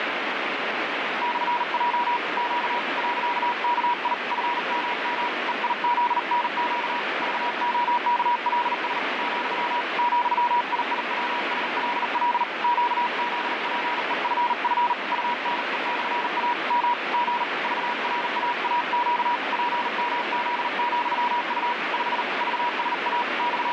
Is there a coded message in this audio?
Yes: Morse code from 1.2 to 23.7 s, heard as a keyed tone, hand-sent with a paddle, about 39 wpm, 960 Hz, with heavy radio static. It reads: /J Q .KI FMM EIZNQ VOKLS , ,IIWSLL QZPEFF UNE/A M G VRAAQ PMZ,U 5 VSA …